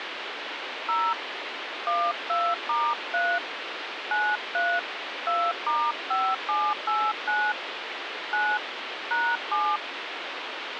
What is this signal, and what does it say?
DTMF, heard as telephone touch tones, dialled by hand, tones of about 250 ms, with phone line noise. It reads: 0 12*3 93 2*5789 9 #7